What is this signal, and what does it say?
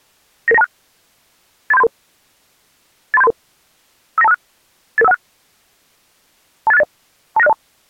Five-tone selective call (EIA), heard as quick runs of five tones, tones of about 30 ms. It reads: 99926 83733 83733 59256 88516 28680 29602